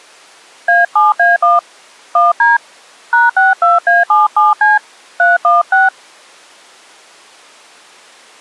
DTMF, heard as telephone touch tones, dialled by hand, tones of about 170 ms. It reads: A7A1 1D #62A77C 316